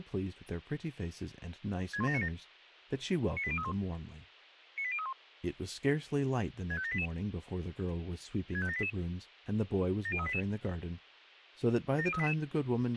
Five-tone selective call (ZVEI), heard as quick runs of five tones, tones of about 70 ms, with a squelch burst at the end and speech in English. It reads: 61797 98031 98031 65788 65788 70388 70388